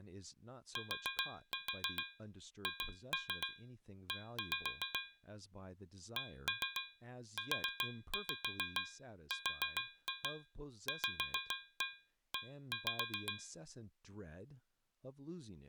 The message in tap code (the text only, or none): THE CURVE